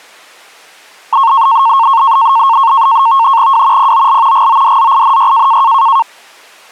NAVTEX (SITOR-B), 100 baud, 170 Hz shift, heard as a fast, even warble, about 1000 Hz centre. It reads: W POL GODZINY